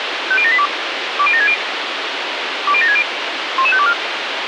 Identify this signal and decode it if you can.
Five-tone selective call (ZVEI), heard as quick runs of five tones, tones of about 70 ms, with radio hiss. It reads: 50782 20760 20760 11524